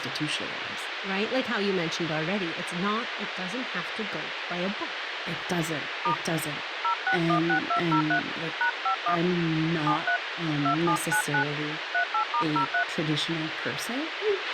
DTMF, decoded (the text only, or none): * 0616203 #51 73 2799 38*03